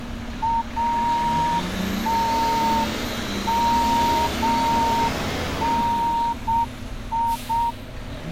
Morse code (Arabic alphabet), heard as a whistle, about 7 wpm, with street noise. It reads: اتمني